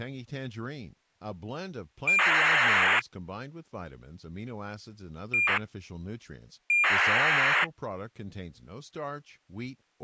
ACARS aircraft data, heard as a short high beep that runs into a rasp, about 2400 baud, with speech in English.